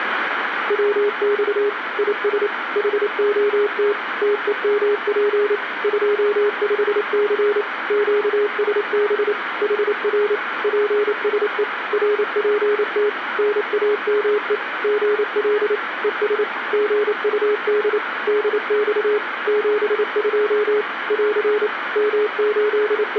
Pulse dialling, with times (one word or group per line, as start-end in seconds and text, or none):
none